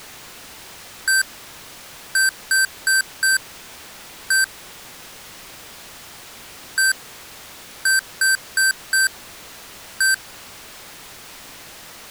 Beep code, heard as beeps from a small speaker, played twice, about 1550 Hz. 1-4-1. In Phoenix BIOS tables: address line failure in the first 64 KB of memory.